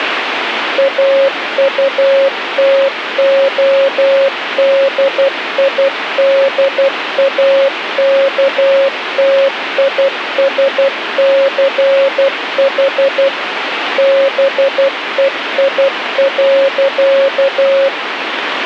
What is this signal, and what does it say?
Morse code, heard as a keyed tone, machine-sent, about 12 wpm, 550 Hz, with radio static. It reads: AUTODIDAKTISCH BEI.